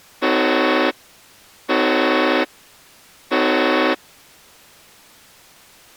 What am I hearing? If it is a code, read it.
Train horn signal, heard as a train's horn. 3 short. On North American railways: when stopped, the train will back up.